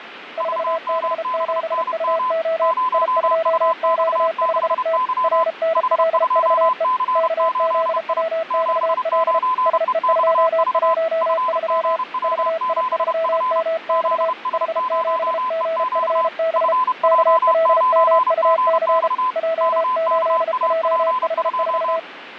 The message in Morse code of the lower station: 4B7UO I2Q5T RNLVE KZWXL SE213 VI3MX H7GFB KLMUC J8JH4

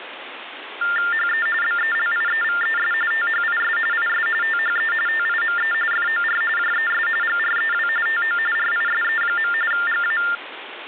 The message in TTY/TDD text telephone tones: HE BELIEVES THIS IS THE TIME FOR JES GREW TO RISE. GA

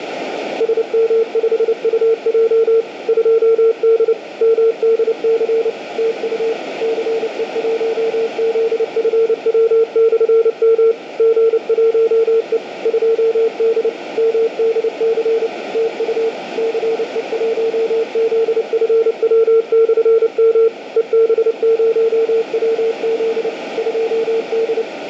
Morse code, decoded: SM5UJ 2D MDC TU CE1ZFW/M G1E 2D MDC TU CE1ZFW/M EB0WZ 2D

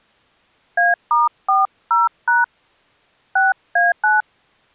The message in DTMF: A*40# 6A9

